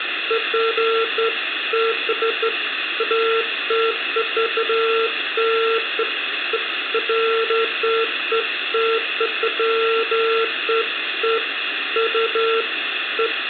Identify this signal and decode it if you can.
Beeps of irregular length, with phone line noise and room echo. There is no code.